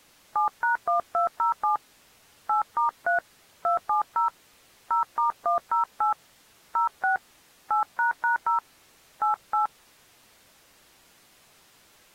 DTMF, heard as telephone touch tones, dialled by hand, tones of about 120 ms. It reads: 7#1207 8*3 270 0*108 06 8##0 88